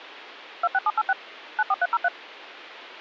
DTMF, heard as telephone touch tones, dialled by machine, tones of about 40 ms. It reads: 26786 94303